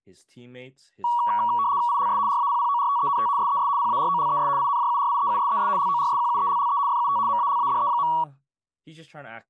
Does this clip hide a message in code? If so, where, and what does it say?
Yes: RTTY (75 baud, 170 Hz shift) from 1.0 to 8.2 s, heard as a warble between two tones, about 1040 Hz centre, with speech in English. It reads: ILS RAPPORTENT SES PAROLES INJURIEUSES LORSQUELLE FUT MALADE.